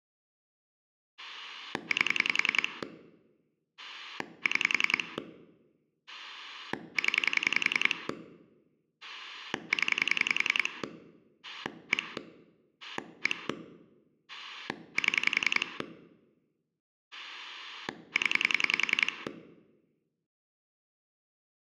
Pulse dialling, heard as a rotary dial, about 10 pulses a second, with room echo. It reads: 8 6 0 0 1 1 7 0